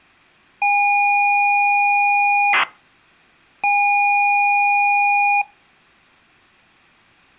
ZX Spectrum tape loading, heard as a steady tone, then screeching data.